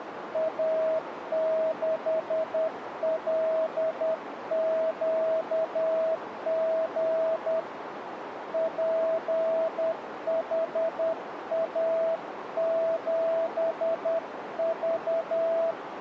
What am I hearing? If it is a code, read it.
Morse code, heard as a keyed tone, hand-sent with a paddle, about 10 wpm, 650 Hz, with radio static and a narrow filter. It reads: A6LQG PHA7V